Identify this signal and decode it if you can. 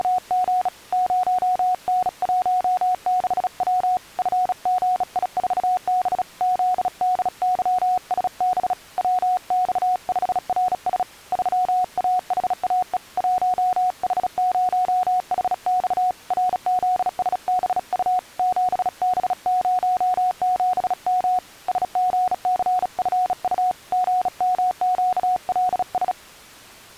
Morse code, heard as a keyed tone, hand-sent with a bug key, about 36 wpm, 730 Hz. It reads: … 0N16W FGI4B ZDYSB WX5RS 3AHAE 1H0HX RZSBU 7B07M SGCFU GMQLS